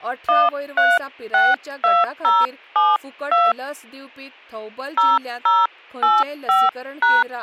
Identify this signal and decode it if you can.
DTMF, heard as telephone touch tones, dialled by hand, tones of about 200 ms, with speech in Goan Konkani. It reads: 1362072 0085#